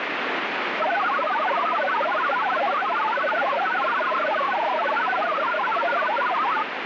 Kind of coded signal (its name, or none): multi-tone FSK (Olivia or MFSK type)